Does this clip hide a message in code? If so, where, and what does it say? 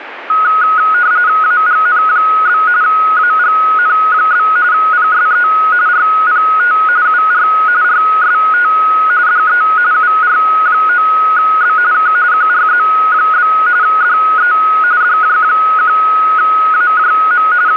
Yes: RTTY (45.45 baud, 170 Hz shift) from 0.3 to 17.8 s, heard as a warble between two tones, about 1360 Hz centre, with radio static. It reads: AGN? AGN? PSE RPT UR RST DE UR9B K QRZ? DE DJ1AJM …